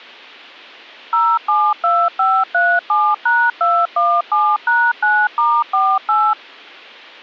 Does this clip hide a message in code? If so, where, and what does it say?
Yes: DTMF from 1.1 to 6.3 s, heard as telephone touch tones, dialled by machine, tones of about 250 ms. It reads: 072537#217#9*48